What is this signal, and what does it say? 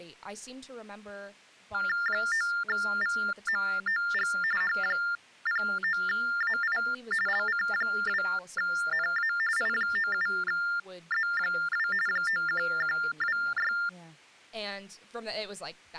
TTY/TDD text telephone tones (45.45 baud Baudot), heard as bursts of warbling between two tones, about 400 Hz shift, 1600 Hz centre, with speech in English. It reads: 9VMOG H09AI LC2NA I97Z2 91126